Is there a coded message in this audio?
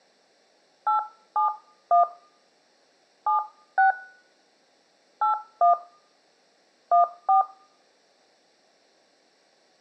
Yes: DTMF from 0.9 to 7.4 s, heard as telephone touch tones, dialled by hand, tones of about 130 ms, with room echo. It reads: 871 76 81 14